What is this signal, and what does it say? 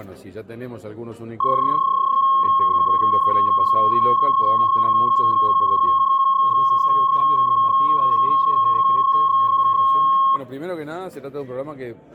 PSK31 (31.25 baud), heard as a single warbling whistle, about 1080 Hz, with room echo.